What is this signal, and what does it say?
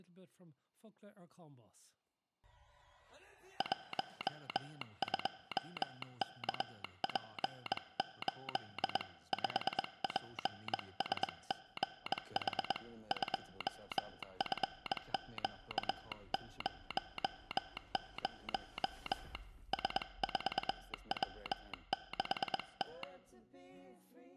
Morse code, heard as a telegraph sounder, hand-sent with a bug key, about 21 wpm. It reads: 12KP8 5PSGH 2FQ00 S4W6T